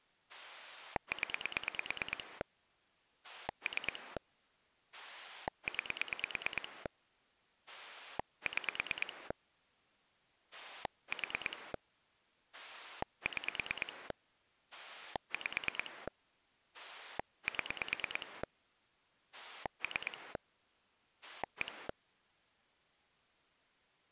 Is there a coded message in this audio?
Yes: pulse dialling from 0.3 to 21.9 s, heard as a rotary dial, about 9 pulses a second. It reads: 0 3 9 6 4 6 5 7 3 1